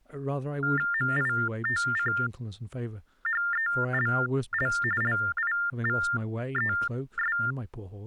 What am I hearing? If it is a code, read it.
TTY/TDD text telephone tones (45.45 baud Baudot), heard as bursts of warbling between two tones, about 400 Hz shift, 1600 Hz centre, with speech in English. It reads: MITCHELL LIVES